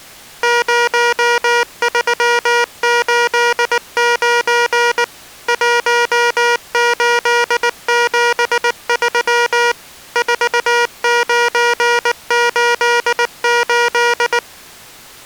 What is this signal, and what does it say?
Morse code, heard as electronic beeps, machine-sent, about 19 wpm, 480 Hz. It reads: 0389 1873 4988